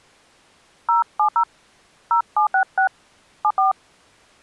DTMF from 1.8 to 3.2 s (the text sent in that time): 0766